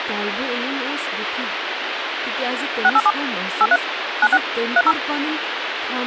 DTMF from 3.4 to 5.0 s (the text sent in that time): 83 96 30